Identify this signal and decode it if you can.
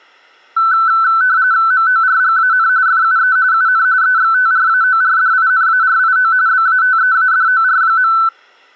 RTTY (45.45 baud, 170 Hz shift), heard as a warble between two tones, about 1420 Hz centre. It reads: MORGAN FUE UN EXTRAORDINARIO BATEADOR.